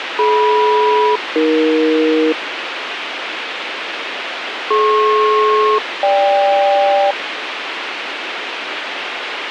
Aircraft SELCAL, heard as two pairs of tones, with radio hiss and a squelch burst at the end. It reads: DM-AE DP-GK